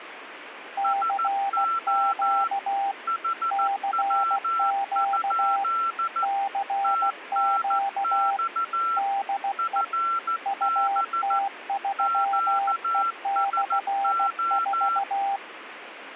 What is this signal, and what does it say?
Morse code, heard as two keyed tones, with radio static. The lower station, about 16 wpm, 790 Hz: CQ CQ CQ DE UT3E/4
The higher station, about 14 wpm, 1350 Hz: SO HW? TNX FB QSO